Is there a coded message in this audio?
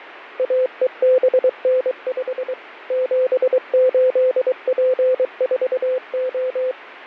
Yes: Morse code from 0.3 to 6.8 s, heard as a keyed tone, machine-sent, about 23 wpm, 510 Hz, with radio static and fading. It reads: AEBN5 78P4O